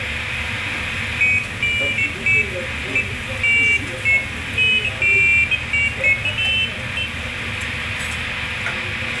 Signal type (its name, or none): none